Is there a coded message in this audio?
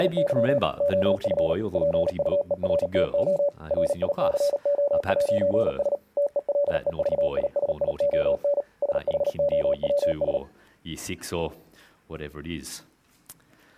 Yes: Morse code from 0.0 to 10.4 s, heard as a keyed tone, machine-sent, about 38 wpm, 570 Hz. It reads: … OF PUERTO RICO'S TELEVISION SHOWS